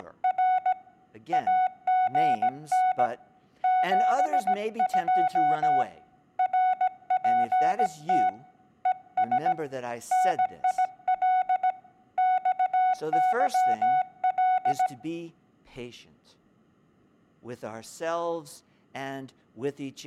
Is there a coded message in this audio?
Yes: Morse code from 0.0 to 14.9 s, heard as a keyed tone, hand-sent with a paddle, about 17 wpm, 740 Hz, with speech in English. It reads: … AGN 72 RPT ES NIL XYL